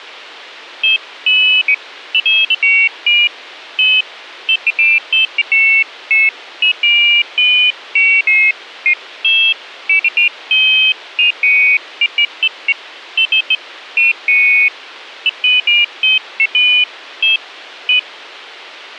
Pairs of high tones at irregular times, with a squelch burst at the end. There is no code.